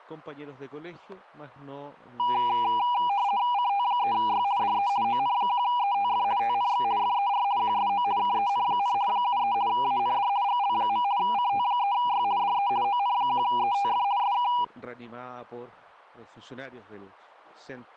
RTTY (50 baud, 170 Hz shift), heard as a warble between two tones, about 890 Hz centre, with static crashes. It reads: CT3Y DE ON1ETF TNX FER QSO KEN, 73 AND GL. CT3Y DE ON1ETF SK